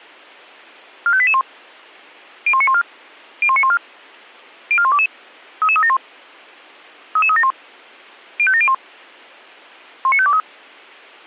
Five-tone selective call (ZVEI), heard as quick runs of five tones, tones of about 70 ms. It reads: 45881 01914 01914 04122 33371 33371 05701 19523